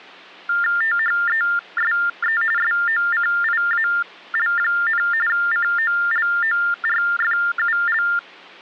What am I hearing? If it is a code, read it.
TTY/TDD text telephone tones (45.45 baud Baudot), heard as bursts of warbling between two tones, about 400 Hz shift, 1600 Hz centre. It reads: THESE SOCIAL, COLORFUL